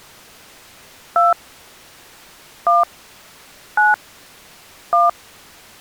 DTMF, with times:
1.2-1.3 2
2.7-2.8 1
3.8-3.9 9
4.9-5.1 1

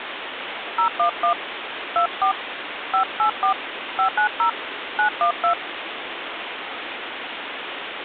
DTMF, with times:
0.8-1.3 011
2.0-2.3 24
2.9-3.5 584
4.0-4.5 590
5.0-5.5 912

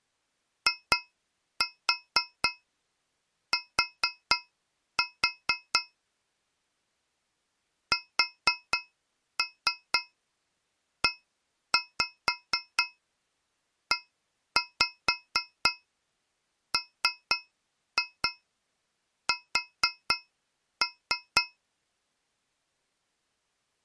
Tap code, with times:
0.7-5.8 IT
7.9-21.4 SEEMS

